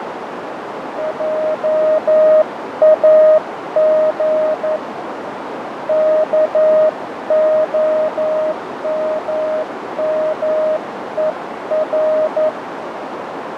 Morse code, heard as a keyed tone, hand-sent with a paddle, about 11 wpm, 620 Hz, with heavy radio static, fading and a narrow filter. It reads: JAG KOMMER